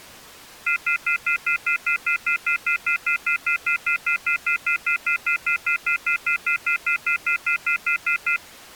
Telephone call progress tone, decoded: off-hook warning tone

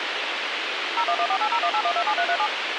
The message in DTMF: 01148018127337

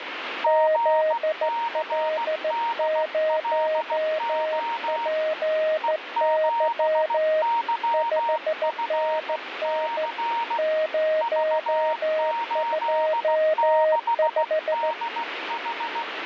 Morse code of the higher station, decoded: GCDLO E7YFC V86DH

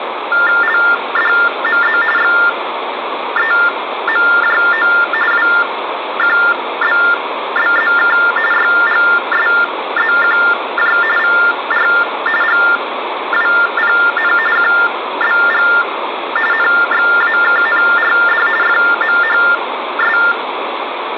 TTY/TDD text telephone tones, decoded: LDMZ XEMJO WQBBZK YGSZQJ VR GWPN QBG NXAKNRD FMHS

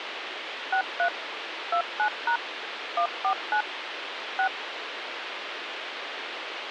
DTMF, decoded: 63 29# 149 6

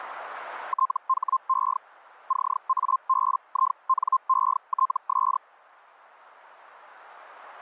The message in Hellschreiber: THE CABINETS

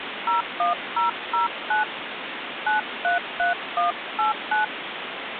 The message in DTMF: 01009 933189

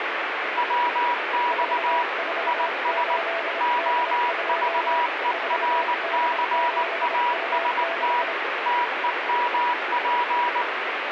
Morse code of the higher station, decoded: WX IS OVERCAST TEMP

